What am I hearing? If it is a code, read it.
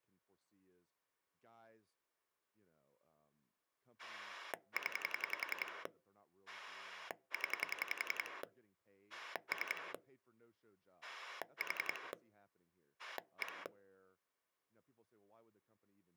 Pulse dialling, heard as a rotary dial, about 11 pulses a second, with speech in English. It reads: 0 0 3 4 1